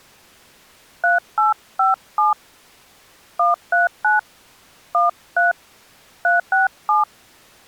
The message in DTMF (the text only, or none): 3857 139 13 367